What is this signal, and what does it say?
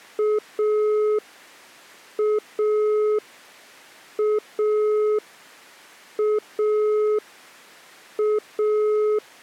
Telephone call progress tone (pulsed, as in Italy), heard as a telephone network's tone, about 420 Hz. Dial tone.